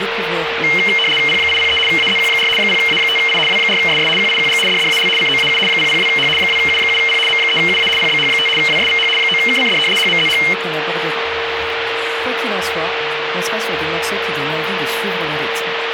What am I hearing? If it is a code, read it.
RTTY (75 baud, 850 Hz shift), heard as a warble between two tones, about 2550 Hz centre, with radio static and a steady whistle near 460 Hz. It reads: P803 AZQ4 0A5I W4SS QIQG DDAL COAU 002H 2U7P M3UA PBH5 WSVH 9KCD HMZH